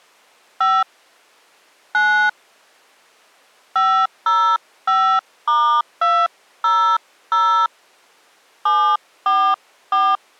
DTMF, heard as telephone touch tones, dialled by hand, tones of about 280 ms. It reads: 5 9 505*200 744